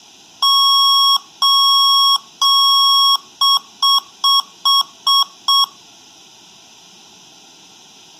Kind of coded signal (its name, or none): beep code